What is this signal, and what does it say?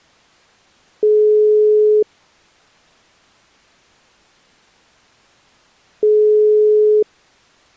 Telephone call progress tone (single-tone plan, as in most of Europe), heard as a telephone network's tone, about 420 Hz, 1 s on and 4 s off. Ringback tone.